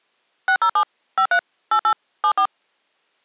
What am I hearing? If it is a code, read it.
DTMF, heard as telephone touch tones, dialled by machine, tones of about 80 ms. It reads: 607 53 88 74